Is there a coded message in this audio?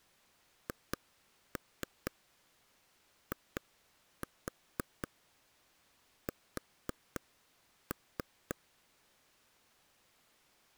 Yes: tap code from 0.7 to 8.5 s, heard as taps on a table, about 4 knocks a second. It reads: HIS